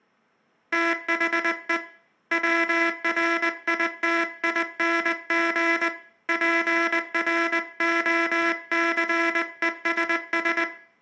Morse code, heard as a buzzer, hand-sent with a paddle, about 20 wpm, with room echo. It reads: THE WRITING PROCESS